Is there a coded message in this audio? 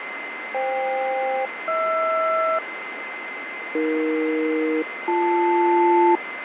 Yes: aircraft SELCAL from 0.5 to 6.2 s, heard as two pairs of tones, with radio static, fading and a steady whistle near 2060 Hz. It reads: FK-HR AE-BL